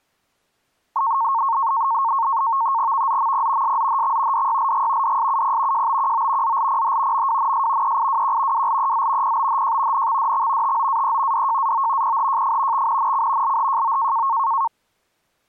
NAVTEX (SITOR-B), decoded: VZMP SZHX DYLG DSUP JBQO ZLPH MWNS EIWQ WLEZ PBHJ NXDX TOAE DJAO PHJF XNNC LHJO

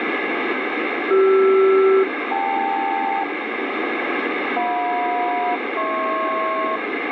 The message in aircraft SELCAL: CR-KL JM-HP

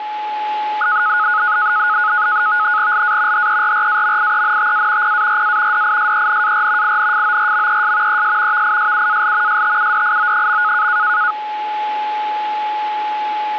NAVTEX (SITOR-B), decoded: LA HERRAMIENTA PARA DISENAR INFORMES ES VISUAL STUDIO.

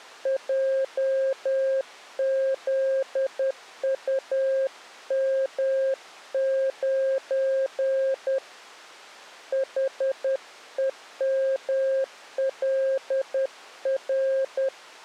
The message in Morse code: JZUM9 HEMLR

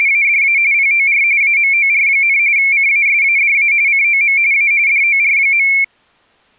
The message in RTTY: … POR AMOR, CASADA COM A DOR.

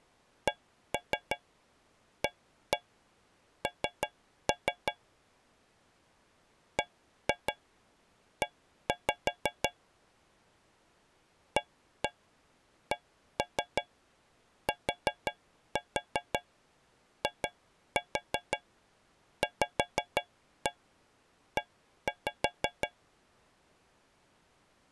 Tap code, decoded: CAN BE ACTIVE

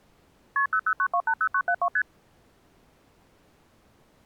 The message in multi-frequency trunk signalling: KP 009280972 ST

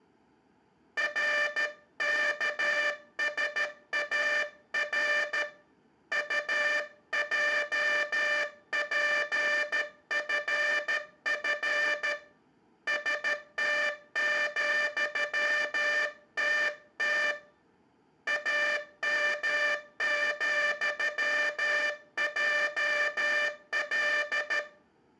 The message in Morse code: RKSAR UJPFF ST,TT AM,JL

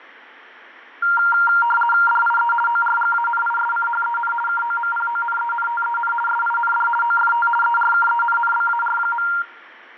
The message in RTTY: DIE ORGANISCHEN KOMPONENTEN SIND OFT ERKENNBAR.

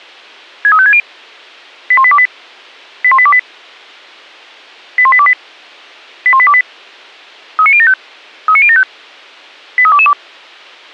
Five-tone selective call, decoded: 63560 81828 81828 81828 81828 39075 39075 83222

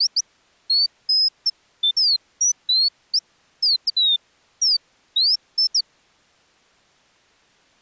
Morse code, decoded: none

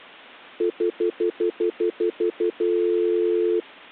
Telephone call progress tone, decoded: stutter dial tone

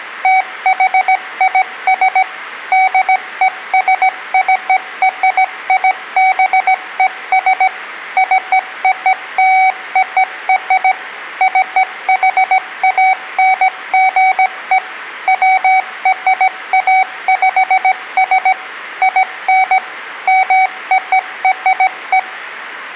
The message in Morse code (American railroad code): THIS DESCRIBES COLOR CHANGE WRAPS IN MORE

